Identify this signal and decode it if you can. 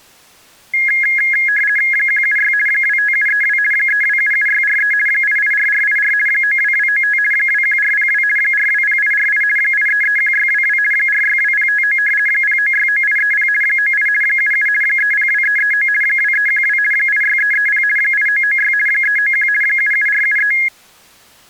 RTTY (50 baud, 450 Hz shift), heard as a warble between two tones, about 1900 Hz centre. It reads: 176 25732 3277643 884484 92295 21402 420848 8331622 462059 0969830 98 77 302339 2312 86330 8996 391 77473